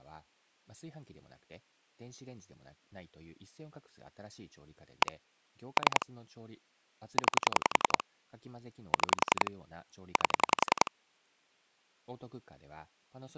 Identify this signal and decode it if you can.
Pulse dialling, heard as clicks on a phone line, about 11 pulses a second, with speech in Japanese. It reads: 1 3 9 6 8